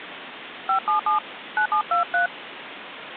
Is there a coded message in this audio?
Yes: DTMF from 0.7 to 2.3 s, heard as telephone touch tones, dialled by hand, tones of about 100 ms, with phone line noise. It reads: 577 9723